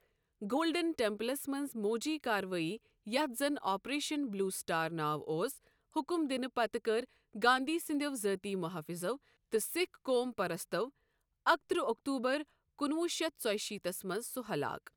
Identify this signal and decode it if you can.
Speech in Kashmiri. There is no code.